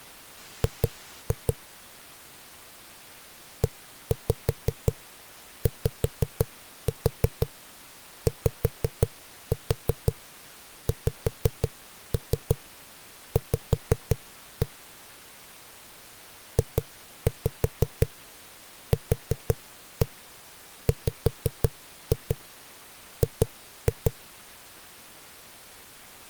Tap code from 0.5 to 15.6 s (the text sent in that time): G EYYXV